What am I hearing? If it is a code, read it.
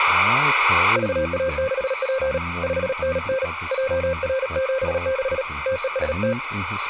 Morse code, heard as a keyed tone, hand-sent with a paddle, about 37 wpm, 530 Hz, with speech in English. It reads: VA6P 5NN JR76 TEST